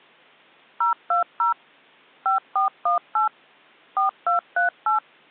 DTMF, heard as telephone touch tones, dialled by machine, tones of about 130 ms. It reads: 020 5418 4238